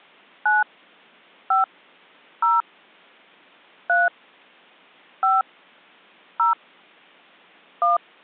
DTMF, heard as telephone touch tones, dialled by hand, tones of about 170 ms. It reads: 9 5 0 3 5 0 1